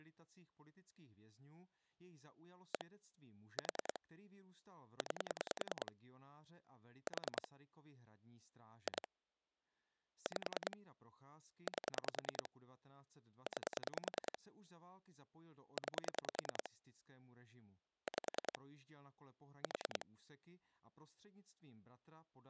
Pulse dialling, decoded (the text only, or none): 1 4 9 4 2 5 8 9 9 5 4